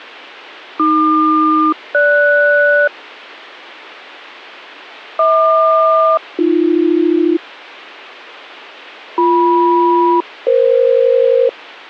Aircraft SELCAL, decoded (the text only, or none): AQ-GS HQ-AB BM-EF